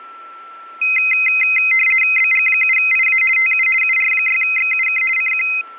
RTTY (50 baud, 450 Hz shift), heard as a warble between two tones, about 2300 Hz centre, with a steady whistle near 1340 Hz. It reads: BG7IA TU UR6XUK CQ